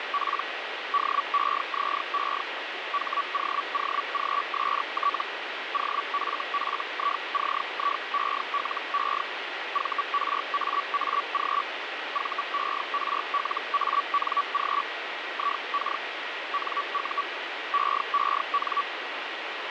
Hellschreiber (Feld-Hell, 122.5 baud), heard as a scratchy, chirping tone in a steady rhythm, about 1140 Hz, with radio static. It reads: … DEZE HOOGST OFFICIELE VRAAG VERLANG IK NU EEN